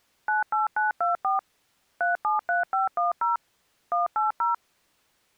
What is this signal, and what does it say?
DTMF, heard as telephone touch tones, dialled by machine, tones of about 140 ms. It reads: 98924 373510 180